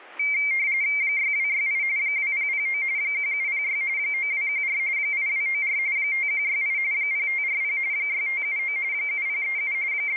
RTTY (45.45 baud, 170 Hz shift), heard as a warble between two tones, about 2200 Hz centre. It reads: 6268 2009 1706 9214 8294 5168 0540 6579 7037 …